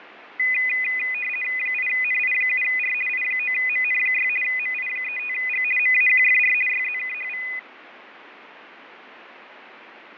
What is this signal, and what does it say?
RTTY (50 baud, 450 Hz shift), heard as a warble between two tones, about 2250 Hz centre, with radio static and fading. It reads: 8NI7R I9MN6 MI35G MAQFR YZKHV